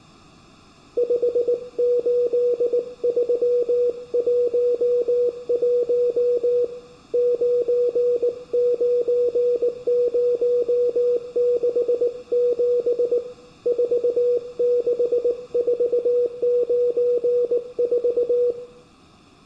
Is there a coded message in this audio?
Yes: Morse code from 0.9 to 18.6 s, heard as a keyed tone, hand-sent with a paddle, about 19 wpm, 490 Hz, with room echo. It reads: 58311 99067 46494